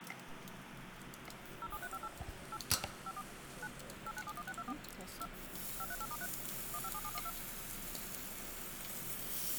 DTMF, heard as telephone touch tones, dialled by machine, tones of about 50 ms, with phone line noise and the noise of a restaurant. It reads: 07358 8 54 9 8971624 2 538*3 157712